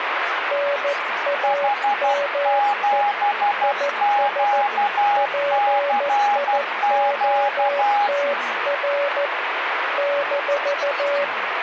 Morse code, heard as two keyed tones, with radio static. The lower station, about 14 wpm, 570 Hz: NAME IS PIOTR -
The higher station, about 12 wpm, 820 Hz: H7QCQ